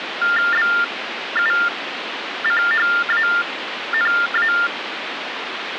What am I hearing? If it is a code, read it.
TTY/TDD text telephone tones (45.45 baud Baudot), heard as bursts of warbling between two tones, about 400 Hz shift, 1600 Hz centre, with phone line noise. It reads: BUCHANA